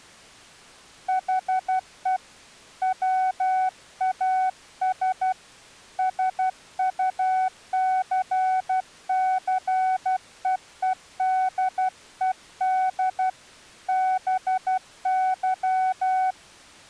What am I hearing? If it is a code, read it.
Morse code, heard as a keyed tone, hand-sent with a paddle, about 12 wpm, 750 Hz. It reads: HE WAS SUCCEEDED BY